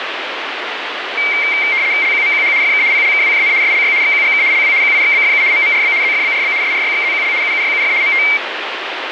RTTY (75 baud, 170 Hz shift), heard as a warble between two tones, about 2200 Hz centre, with radio static. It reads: LQMQH FK PLKWJN SLY XQGK LW QIXBFU MMRB ZFBRB SRYXZQL UUYUF MT